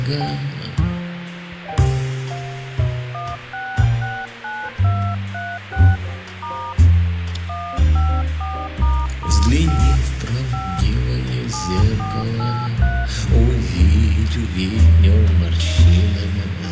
DTMF, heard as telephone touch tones, dialled by hand, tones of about 260 ms, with radio hiss. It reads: 1669236 * 154**5 5 7483